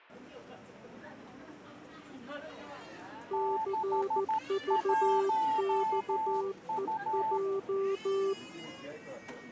Morse code, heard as two keyed tones, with the noise of a crowd indoors. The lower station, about 14 wpm, 390 Hz: CVXEJ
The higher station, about 13 wpm, 880 Hz: 61U